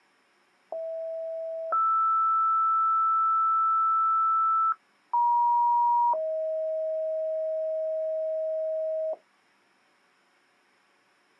Two-tone page, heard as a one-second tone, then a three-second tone, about 650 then 1320 Hz, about 950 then 630 Hz.